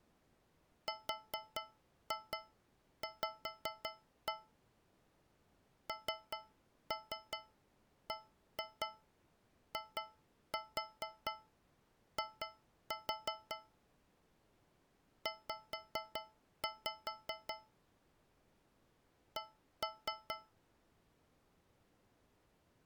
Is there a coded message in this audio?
Yes: tap code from 0.9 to 20.6 s, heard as taps on a metal pipe, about 5 knocks a second. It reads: RV NBII Z C